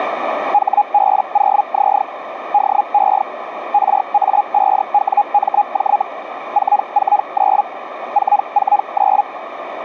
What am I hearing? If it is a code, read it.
Hellschreiber (Feld-Hell, 122.5 baud), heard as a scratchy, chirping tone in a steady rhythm, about 820 Hz, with radio static and a narrow filter. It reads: HB0Z DE RA5WMJ 449 449